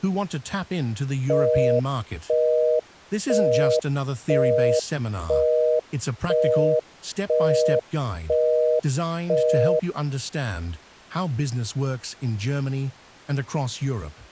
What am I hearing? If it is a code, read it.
Telephone call progress tone (North American plan), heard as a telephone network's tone, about 480, 620 Hz, 0.5 s on and 0.5 s off. Busy tone.